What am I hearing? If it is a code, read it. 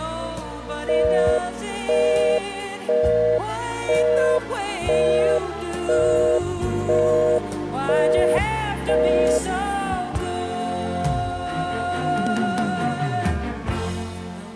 Telephone call progress tone (North American plan), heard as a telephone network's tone, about 480, 620 Hz, 0.5 s on and 0.5 s off. Busy tone.